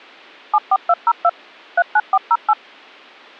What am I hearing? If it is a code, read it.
DTMF, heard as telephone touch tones, dialled by machine, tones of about 50 ms. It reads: 74202 39408